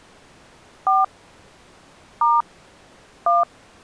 DTMF, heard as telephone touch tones, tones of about 160 ms. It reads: 4 * 1